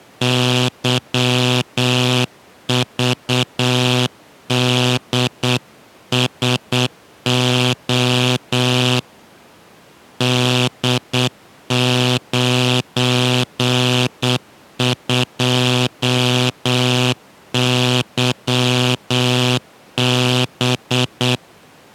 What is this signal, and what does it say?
Morse code, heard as a buzzer, hand-sent with a paddle, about 8 wpm. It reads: YVDSO D92YB